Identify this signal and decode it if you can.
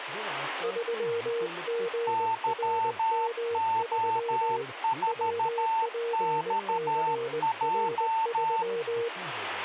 Morse code, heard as two keyed tones, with radio static and speech in Hindi. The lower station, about 20 wpm, 470 Hz: 3GRM3 WPCR3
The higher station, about 13 wpm, 900 Hz: YO4XJ